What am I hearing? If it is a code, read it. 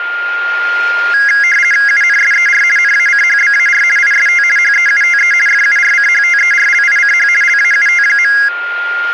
RTTY (50 baud, 450 Hz shift), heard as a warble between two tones, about 1900 Hz centre, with a steady whistle near 1410 Hz. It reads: UNSER NACHBAR IST HEUTE FURCHTERLICH LAUT.